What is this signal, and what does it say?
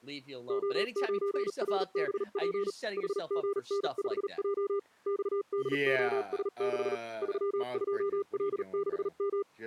Morse code, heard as a keyed tone, machine-sent, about 38 wpm, spaced as for 35 wpm, 400 Hz, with speech in English. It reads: O9RBP HGN5J XDOS6 32L6M